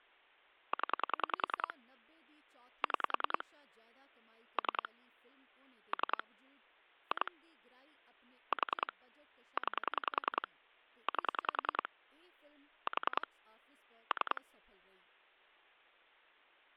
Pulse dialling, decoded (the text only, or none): 0 6 3 3 2 4 9 8 4 3